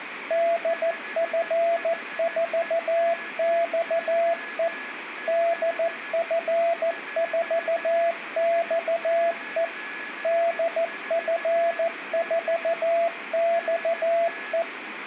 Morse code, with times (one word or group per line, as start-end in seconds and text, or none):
0.3-4.7 DF4XE
5.3-9.6 DF4XE
10.2-14.6 DF4XE